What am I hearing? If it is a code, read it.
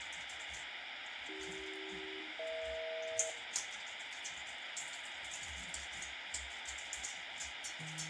Aircraft SELCAL, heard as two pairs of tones, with radio static and the noise of a restroom. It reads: AC-EH